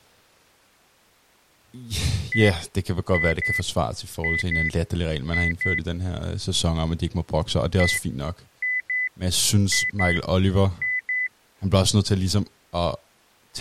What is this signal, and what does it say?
Beep code, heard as beeps, played twice, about 2000 Hz, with speech in Danish. 1-2-2-2.